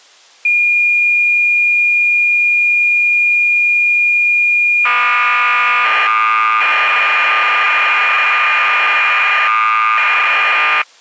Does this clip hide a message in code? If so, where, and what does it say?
Yes: cassette data (Kansas City type), 1200 baud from 0.4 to 10.8 s, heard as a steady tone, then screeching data.